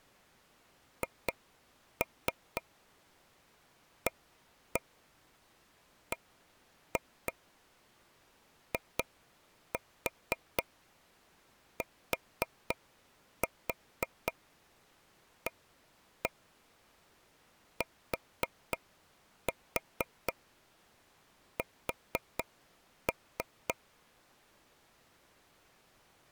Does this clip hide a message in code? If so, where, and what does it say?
Yes: tap code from 1.0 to 23.7 s, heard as taps on a table, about 4 knocks a second. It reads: HABITATS